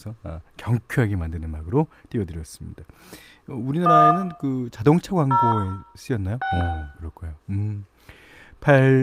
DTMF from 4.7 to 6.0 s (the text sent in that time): 0